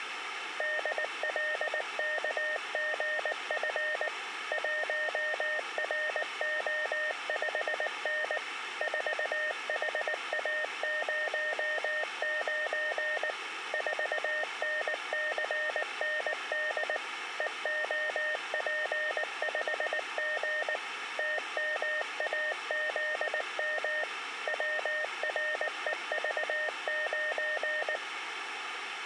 Morse code, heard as a keyed tone, machine-sent, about 19 wpm, 610 Hz. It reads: DLKGF 1RO5N 4HA09 4NCND EOP5G TMAZM WREV9